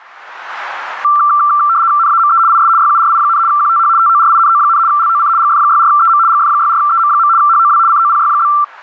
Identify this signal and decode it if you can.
RTTY (75 baud, 170 Hz shift), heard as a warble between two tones, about 1260 Hz centre, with static crashes. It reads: NAME IS YURI, QTH TORINO, LOC GF64EM GF64EM. HOW COPY?